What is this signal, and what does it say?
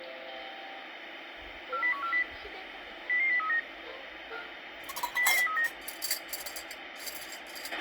Five-tone selective call (CCIR), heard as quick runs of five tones, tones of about 100 ms, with radio hiss, a squelch burst at the end, room echo and kitchen noise. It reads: 40140 00039 00039